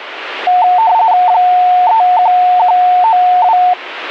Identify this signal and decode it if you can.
RTTY (45.45 baud, 170 Hz shift), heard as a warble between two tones, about 810 Hz centre. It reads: 31192